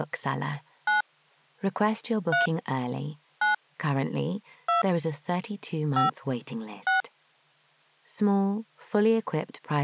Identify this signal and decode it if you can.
DTMF, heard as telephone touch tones, dialled by hand, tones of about 140 ms. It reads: 9 3 9 2 5 6